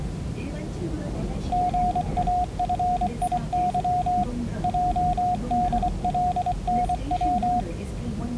Morse code, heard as a keyed tone, hand-sent with a paddle, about 24 wpm, 720 Hz, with the noise inside a subway train. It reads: GAFIY JDLNW